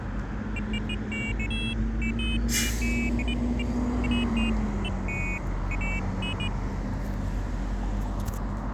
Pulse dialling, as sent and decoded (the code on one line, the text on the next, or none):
none